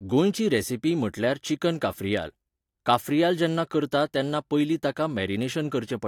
Speech in Goan Konkani. There is no code.